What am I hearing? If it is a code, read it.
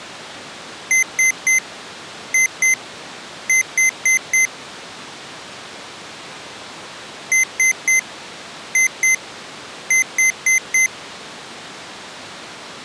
Beep code, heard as beeps from a small speaker, played twice, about 2050 Hz. 3-2-4. In Phoenix BIOS tables: keyboard controller failure.